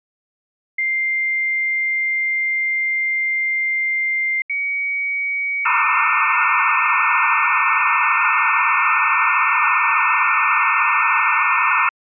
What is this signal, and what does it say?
Dial-up modem handshake (low-speed, two carriers), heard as two whistles, then hiss.